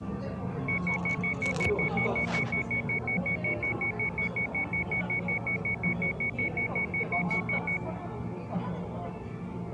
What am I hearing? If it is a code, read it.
Evenly repeated beeps, with the noise of a cafe. There is no code.